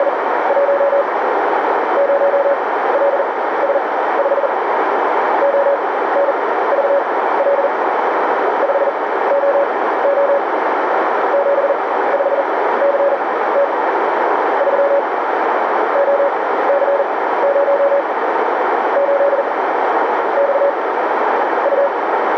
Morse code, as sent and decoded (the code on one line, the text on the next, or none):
… / ----- .-.. ... ..... / --- -. ...- .-.. / ..... --- --- / --... ..... -.-. - / ...-- / --- -.-. ----- / ---.. / -..- / ..-
… 0LS5 ONVL 5OO 75CT 3 OC0 8 X U